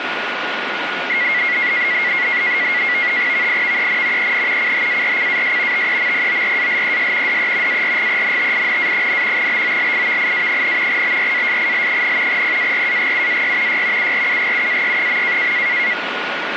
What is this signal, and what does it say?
NAVTEX (SITOR-B), 100 baud, 170 Hz shift, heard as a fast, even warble, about 2050 Hz centre, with radio static and a steady whistle near 1440 Hz. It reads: VIVEN EN CHARCAS TEMPORALES DE ARGENTINA, BOLIVIA, BRASIL, PARAGUAY Y URUGUAY.